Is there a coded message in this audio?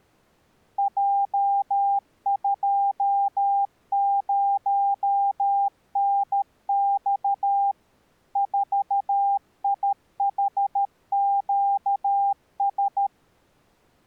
Yes: Morse code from 0.7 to 13.1 s, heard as a keyed tone, machine-sent, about 13 wpm, 800 Hz. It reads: J20NX 4IHQS